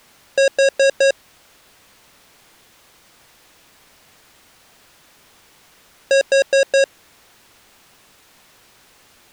Alarm pattern, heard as an alarm's beeps, played twice, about 550 Hz. Temporal four. Carbon monoxide.